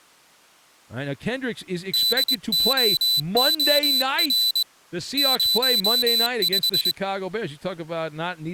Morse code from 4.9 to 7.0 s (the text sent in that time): 05